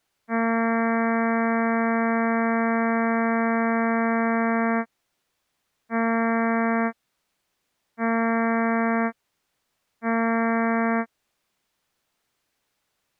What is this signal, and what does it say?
Ship horn signal, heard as a ship's horn, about 230 Hz. 1 long, 3 short. At sea: a vessel under tow in fog.